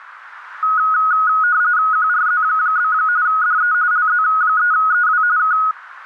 RTTY (45.45 baud, 170 Hz shift), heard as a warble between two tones, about 1360 Hz centre, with radio static. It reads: QRZ? DE LZ3EW K